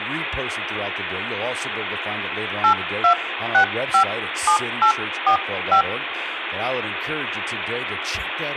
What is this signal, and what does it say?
DTMF, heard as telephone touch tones, dialled by hand, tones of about 100 ms, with phone line noise, room echo and speech in English. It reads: 82657845